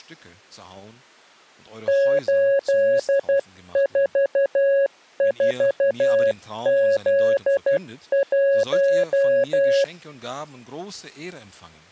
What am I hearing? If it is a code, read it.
Morse code, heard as a keyed tone, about 12 wpm, 550 Hz. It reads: 844Z1